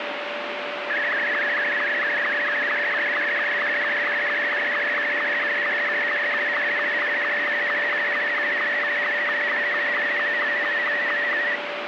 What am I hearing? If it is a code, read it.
SSTV (slow-scan television), Martin M2, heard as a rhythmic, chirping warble, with radio static and a steady whistle near 580 Hz.